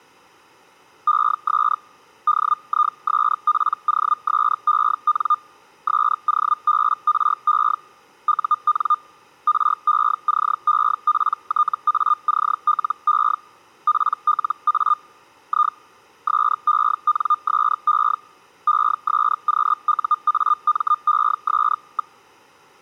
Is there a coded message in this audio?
Yes: Hellschreiber (Feld-Hell, 122.5 baud) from 1.1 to 22.2 s, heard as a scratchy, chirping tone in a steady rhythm, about 1210 Hz. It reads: ES DISPOSEN SOBRE UN RECEPTACLE PLA I SENSE ESQUAMES.